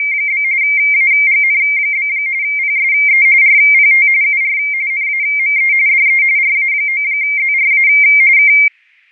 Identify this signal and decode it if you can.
RTTY (45.45 baud, 170 Hz shift), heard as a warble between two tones, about 2200 Hz centre, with fading. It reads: … AGN? PSE RPT UR NAME DE RA9ZRA K